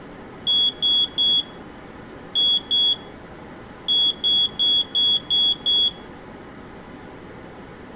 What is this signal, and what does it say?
Beep code, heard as a piezo beeper, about 3350 Hz, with room echo. 3-2-6.